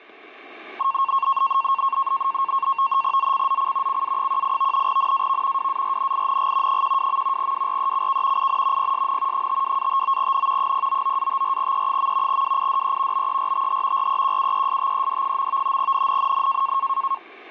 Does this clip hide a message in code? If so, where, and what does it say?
Yes: NAVTEX (SITOR-B), 100 baud, 170 Hz shift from 0.8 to 17.2 s, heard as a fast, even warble, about 1000 Hz centre. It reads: ZCZC CA18 NAV WARNING 12. WRECK IN PSN 52-59N 099-54E. WIDE BERTH REQUESTED. NNNN